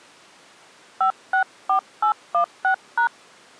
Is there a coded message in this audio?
Yes: DTMF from 1.0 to 3.1 s, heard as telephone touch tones, dialled by hand, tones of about 100 ms. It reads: 564816#